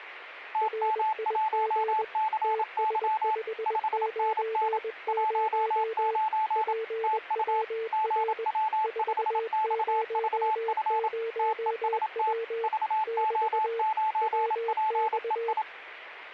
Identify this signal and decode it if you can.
Morse code, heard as two keyed tones. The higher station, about 27 wpm, 870 Hz: TM1CY 5NN 19 TU GW5XVF TEST VO9PEI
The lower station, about 21 wpm, 450 Hz: RIG TS590 PWR 400W <BT> WX